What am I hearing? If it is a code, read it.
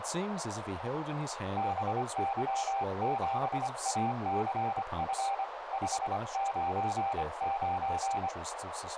Morse code, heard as a keyed tone, hand-sent with a paddle, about 25 wpm, 790 Hz, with radio static, a narrow filter and speech in English. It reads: BY7ACF 599